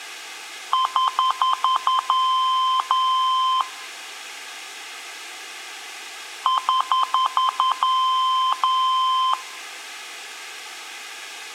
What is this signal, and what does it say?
Beep code, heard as beeps, played twice, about 1040 Hz, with room echo. 6 short, 2 long.